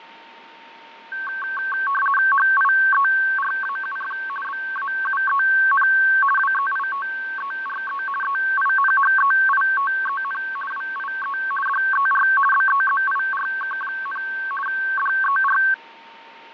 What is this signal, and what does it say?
RTTY (50 baud, 450 Hz shift), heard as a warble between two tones, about 1330 Hz centre, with fading and a steady whistle near 920 Hz. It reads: HIERAUF BAUEN WEITERE EINHEITEN WIE DER BEZIRK, DER